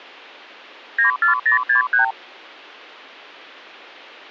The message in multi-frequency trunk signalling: 94063

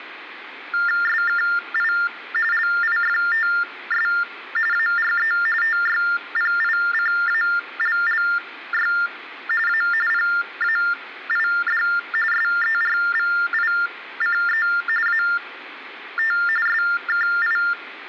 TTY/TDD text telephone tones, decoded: SKI LIFTS ARE TYPICALLY A PAID SERVICE AT SKI

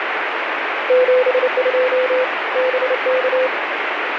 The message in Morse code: 72 BK

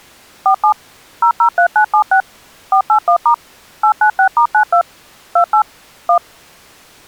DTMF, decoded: 47 003976 481* 896*92 28 1

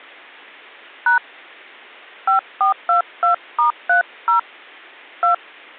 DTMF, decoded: # 5422*30 2

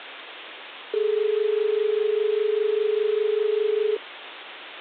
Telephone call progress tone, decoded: dial tone

